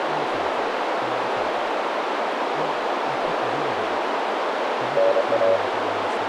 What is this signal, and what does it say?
Morse code (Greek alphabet), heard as a keyed tone, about 27 wpm, 570 Hz, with heavy radio static, a narrow filter and speech in English. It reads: ΝΑ